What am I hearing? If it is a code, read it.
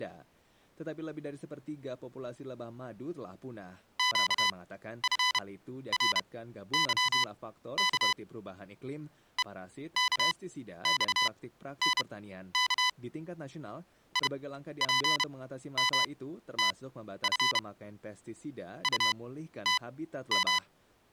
Morse code, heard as electronic beeps, machine-sent, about 31 wpm, spaced as for 13 wpm, 1000 Hz. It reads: QFRYK EKXNK IPMTF …